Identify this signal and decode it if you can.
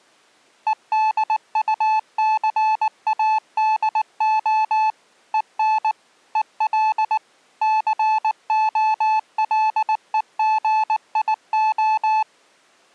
Morse code, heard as a keyed tone, machine-sent, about 19 wpm, 870 Hz. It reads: EDUCADO EN EL COLEGIO